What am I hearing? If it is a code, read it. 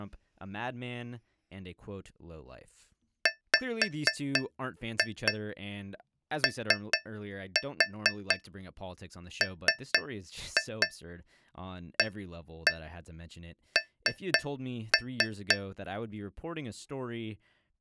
Tap code, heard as taps on a metal pipe, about 4 knocks a second, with speech in English. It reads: WOMAN